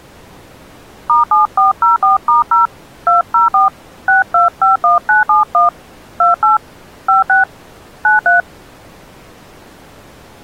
DTMF, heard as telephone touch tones, dialled by hand, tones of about 140 ms. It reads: *7404*0 204 6251971 28 56 93